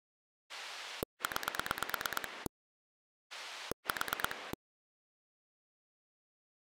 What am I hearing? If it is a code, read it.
Pulse dialling, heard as a rotary dial, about 9 pulses a second. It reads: 9 4